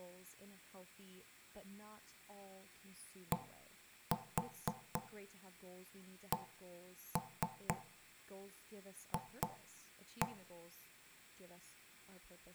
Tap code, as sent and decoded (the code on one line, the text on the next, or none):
1-4 1-3 2-1
DCF